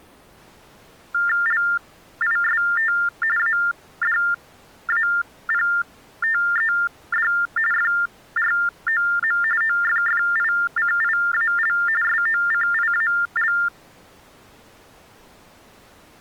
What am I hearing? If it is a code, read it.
TTY/TDD text telephone tones (45.45 baud Baudot), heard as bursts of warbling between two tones, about 400 Hz shift, 1600 Hz centre. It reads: LIST ADAPTED FROM OFFICIAL SOCIAL